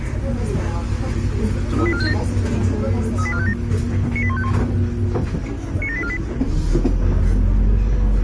Five-tone selective call (ZVEI), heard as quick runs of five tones, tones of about 70 ms, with the noise inside a bus. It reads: 38457 38457 98151 97848